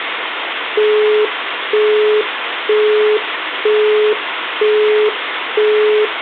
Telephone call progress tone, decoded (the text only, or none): busy tone